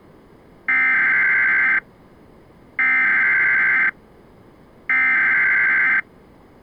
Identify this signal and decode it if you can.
Emergency Alert System (SAME) tones (header bursts), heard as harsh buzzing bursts, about 520.83 baud.